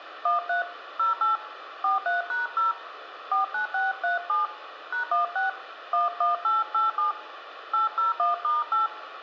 DTMF, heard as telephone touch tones, dialled by hand, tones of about 140 ms, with radio hiss and room echo. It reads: 13 08 43#0 49637 #16 11887 801*8